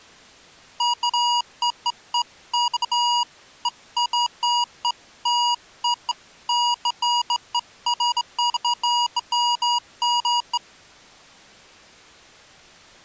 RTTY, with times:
none

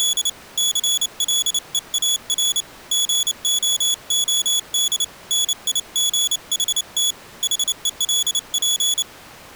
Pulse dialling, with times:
none

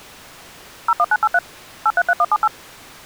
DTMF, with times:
0.9-1.4 01983
1.9-2.5 833178

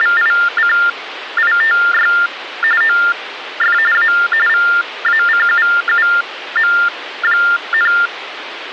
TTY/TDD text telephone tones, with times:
0.0-2.1 …
2.8-3.8 OF
3.9-4.1 A
4.5-7.9 VACUUM,

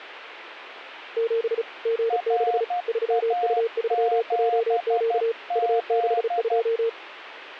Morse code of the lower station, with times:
1.2-1.6 7
1.9-2.6 G6
2.9-5.3 3U3JQ
5.6-6.9 U62

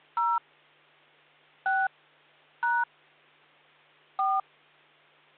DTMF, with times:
0.2-0.4 0
1.7-1.9 6
2.6-2.8 #
4.2-4.4 4

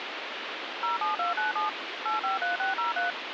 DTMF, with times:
0.8-1.7 07297
2.1-3.1 853603

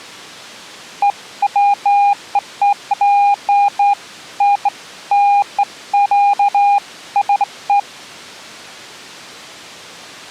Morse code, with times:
none

